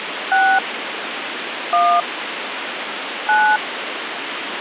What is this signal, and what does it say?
DTMF, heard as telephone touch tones, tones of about 270 ms, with phone line noise. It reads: 6 1 9